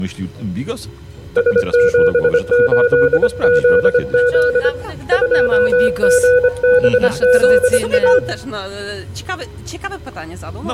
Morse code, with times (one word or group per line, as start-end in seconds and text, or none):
1.4-4.7 S78ZZ
5.1-8.2 2GBZA